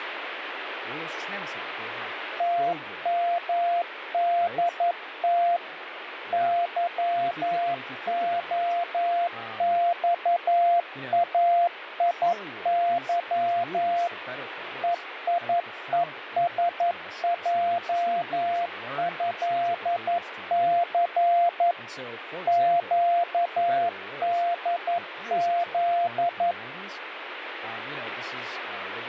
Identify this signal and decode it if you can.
Morse code (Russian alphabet), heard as a keyed tone, machine-sent, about 11 wpm, 690 Hz, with radio static and speech in English. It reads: ТМДТ ЫОЬАИЫ ЕИЕСЙЭЦ ЩДЗ